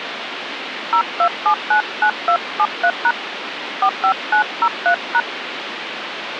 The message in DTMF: 02799273# 45903#

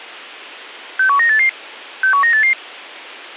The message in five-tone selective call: 61988 61988

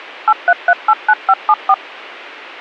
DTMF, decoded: 83389574

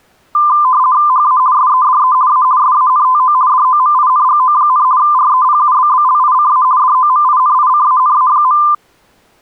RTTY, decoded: HA SEDE A SANTO DOMINGO, REPUBBLICA DOMINICANA.

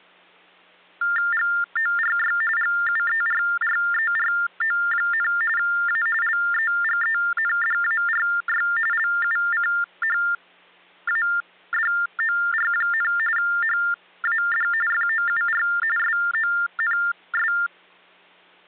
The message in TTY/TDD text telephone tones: GORY GUERRERO, A LEGENDARY LUCHADOR, HAD FOUR SONS

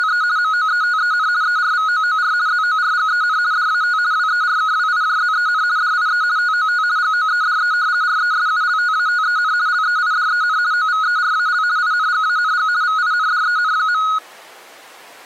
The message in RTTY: … MOETEN ERVOOR ZORGEN DAT WERKWIJZEN DIE TOT GOEDE RESULTATEN LEIDEN OVERAL INGANG VINDEN.

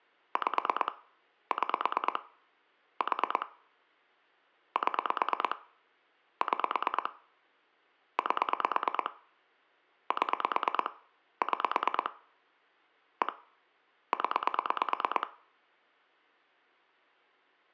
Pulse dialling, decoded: 5 6 4 7 6 8 7 6 1 0

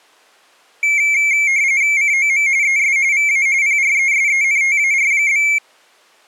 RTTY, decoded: COM ES VA PRESENTAR?

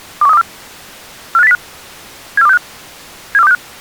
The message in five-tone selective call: 21324 45805 74265 74265

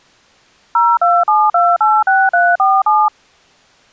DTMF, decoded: 027286347

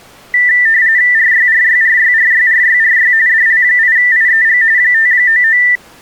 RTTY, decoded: RYRYRYRYRYRY DL8IEG 599

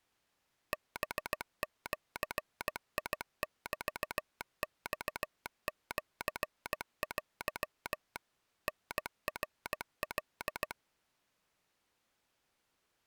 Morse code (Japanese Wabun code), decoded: ハジメマシテ タナカ

